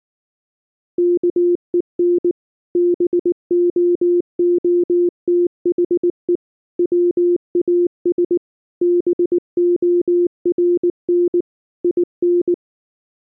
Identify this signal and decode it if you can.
Morse code, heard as a keyed tone, machine-sent, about 19 wpm, 350 Hz. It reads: KEN BOOTHE WAS BORN IN